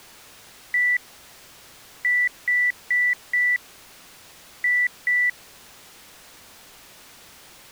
Beep code, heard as beeps, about 1950 Hz. 1-4-2. In Phoenix BIOS tables: parity failure in the first 64 KB of memory.